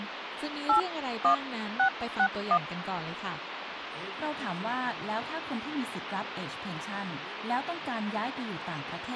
DTMF, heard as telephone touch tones, dialled by hand, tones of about 80 ms, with phone line noise. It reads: 81661